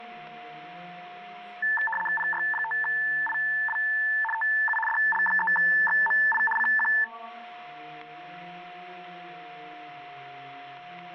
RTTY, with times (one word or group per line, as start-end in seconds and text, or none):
2.2-3.8 PY5IW
4.3-4.8 TU
4.9-6.4 DL3XMI
6.6-6.9 CQ